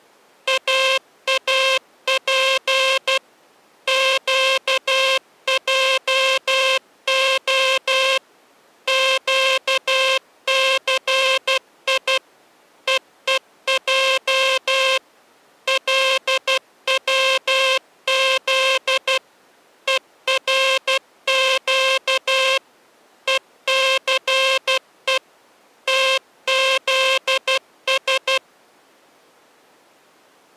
Morse code (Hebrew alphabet), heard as a buzzer, machine-sent, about 12 wpm. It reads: אאף קעה קסי ווע לצז ורק וסו תזש